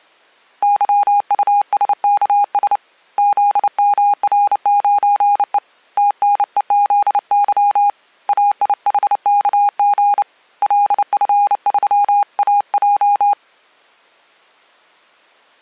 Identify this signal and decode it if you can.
Morse code, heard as a keyed tone, hand-sent with a bug key, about 29 wpm, 820 Hz. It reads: YUSKS ZMR9E TNEZY AIHKG LF3AJ